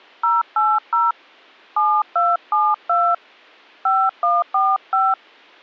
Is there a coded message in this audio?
Yes: DTMF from 0.2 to 5.1 s, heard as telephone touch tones, dialled by hand, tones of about 220 ms. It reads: 080 7272 5145